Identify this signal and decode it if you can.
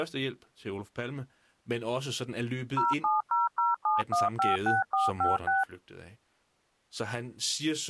DTMF, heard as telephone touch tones, dialled by machine, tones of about 160 ms, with speech in Danish. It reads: 07007156456